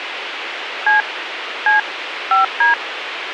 DTMF, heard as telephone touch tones, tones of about 140 ms, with radio hiss and a squelch burst at the end. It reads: C C 5D